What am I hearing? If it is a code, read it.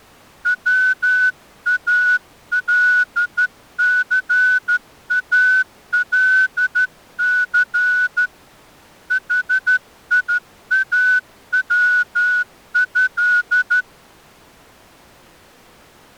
Morse code (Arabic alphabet), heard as a whistle, hand-sent with a straight key, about 12 wpm. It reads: والثالث حياوه